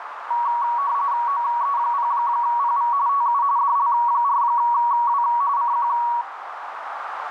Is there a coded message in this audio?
Yes: RTTY (45.45 baud, 170 Hz shift) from 0.3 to 6.2 s, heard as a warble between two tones, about 1040 Hz centre, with radio static and a narrow filter. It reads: OE0PV TU DL4W CQ